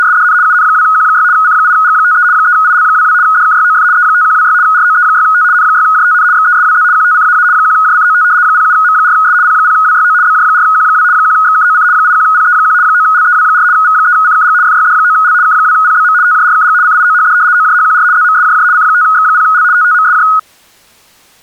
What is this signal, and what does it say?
RTTY (75 baud, 170 Hz shift), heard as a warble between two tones, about 1360 Hz centre. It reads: … UN2Q6 C8G53 3IL22 DKYOF E5126 ROE6T N6JTN XESWZ QTCAA 1JCOT 07M4S P0WYO BJ4Q2 1XKOC 81PE1 9LEW4 V3CKG FYD9L K2PBM TJRKG CIOHD OJHQR ZMSJJ C5X0L TTMSJ